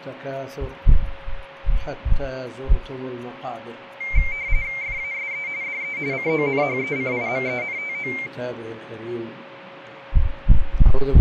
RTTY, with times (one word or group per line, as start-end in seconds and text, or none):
4.8-5.5 FASE
5.6-6.0 DE
6.1-8.1 CONHECIMENTO